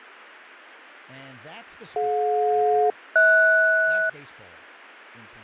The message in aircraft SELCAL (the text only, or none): DJ-HS